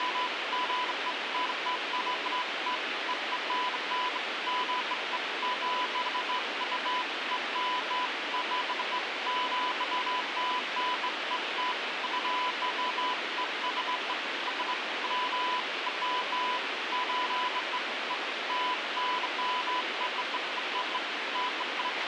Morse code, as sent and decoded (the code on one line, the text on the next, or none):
none